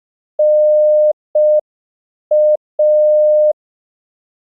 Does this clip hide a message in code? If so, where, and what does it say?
Yes: Morse code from 0.3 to 3.6 s, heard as a keyed tone, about 5 wpm, 610 Hz. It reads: NA